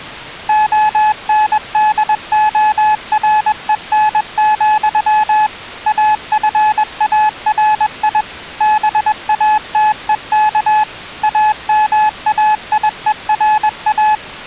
Morse code, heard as a keyed tone, machine-sent, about 21 wpm, 860 Hz. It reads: ONDOREN, AFARI BATEK AMAIERA